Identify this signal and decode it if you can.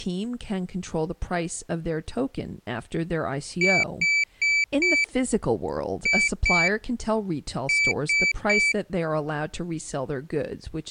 Beep code, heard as a piezo beeper, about 2300 Hz, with speech in English. 4-2-3. In Phoenix BIOS tables: gate A20 failure.